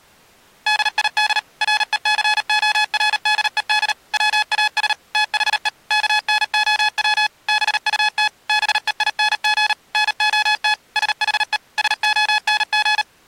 Morse code, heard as electronic beeps, machine-sent, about 38 wpm, 850 Hz. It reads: DID RECORDED WAS THE KNOW BUT BEING NOT SHE SONG